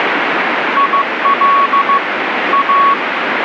Morse code, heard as a keyed tone, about 15 wpm, 1120 Hz, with radio static. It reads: IL A